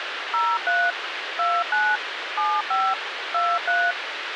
DTMF, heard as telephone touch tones, dialled by machine, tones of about 240 ms, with radio hiss. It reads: 03 29 75 23